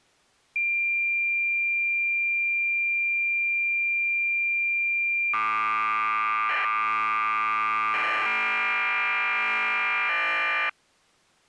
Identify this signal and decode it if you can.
Cassette data (Kansas City type), 1200 baud, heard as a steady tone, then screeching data.